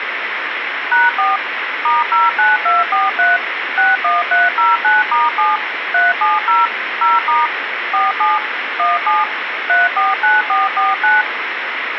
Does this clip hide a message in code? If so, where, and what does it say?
Yes: DTMF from 0.9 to 11.2 s, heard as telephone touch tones, dialled by machine, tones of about 180 ms, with phone line noise. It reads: #4 *09243 61309*7 370 0* 47 17 349449